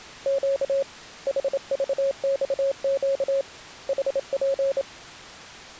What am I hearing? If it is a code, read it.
Morse code, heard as a keyed tone, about 27 wpm, 550 Hz. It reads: Q HVXQ HP